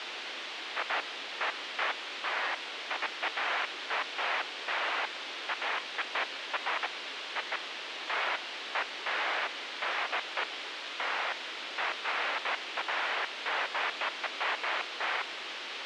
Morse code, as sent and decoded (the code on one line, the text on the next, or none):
none